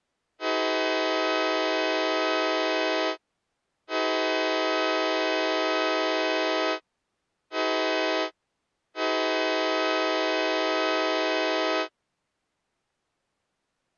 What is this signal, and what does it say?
Train horn signal, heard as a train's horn. 2 long, 1 short, 1 long. On North American railways: approaching a public crossing.